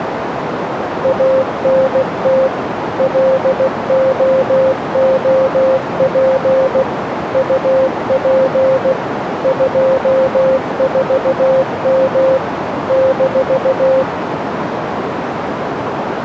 Morse code, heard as a keyed tone, machine-sent, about 16 wpm, 530 Hz, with radio static and a narrow filter. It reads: ANT LOOP UP 24M -